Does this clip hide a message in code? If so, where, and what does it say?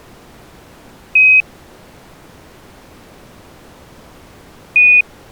Yes: Quindar tones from 1.2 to 5.0 s, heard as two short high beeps.